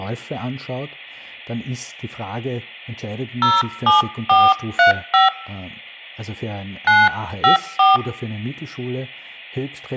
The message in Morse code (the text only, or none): none